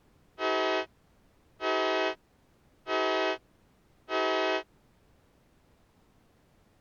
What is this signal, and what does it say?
Train horn signal, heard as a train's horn. 4 short. On North American railways: a request for a signal to be given or repeated.